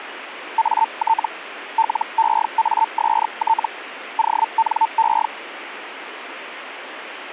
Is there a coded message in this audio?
Yes: Hellschreiber (Feld-Hell, 122.5 baud) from 0.6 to 5.3 s, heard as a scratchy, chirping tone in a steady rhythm, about 900 Hz, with radio static. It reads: AT LEAST ONE